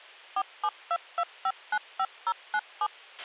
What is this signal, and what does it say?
DTMF, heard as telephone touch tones, dialled by machine, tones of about 60 ms, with a squelch burst at the end. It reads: 4722595097